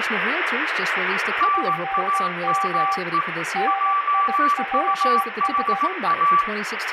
Morse code, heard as two keyed tones, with radio static, room echo and speech in English. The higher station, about 18 wpm, 1160 Hz: NAME JUHA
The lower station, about 17 wpm, 780 Hz: GM NILS